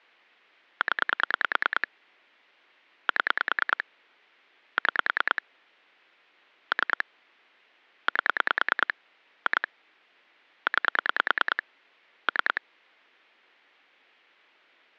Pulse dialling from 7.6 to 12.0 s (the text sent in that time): 8 2 9